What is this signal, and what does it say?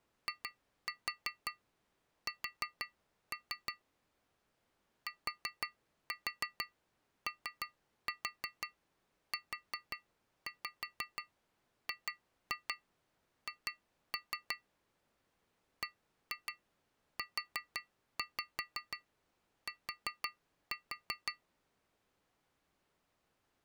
Tap code, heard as taps on glass, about 5 knocks a second. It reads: IS TOUGH BUT